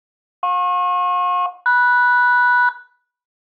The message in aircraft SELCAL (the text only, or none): JP-MS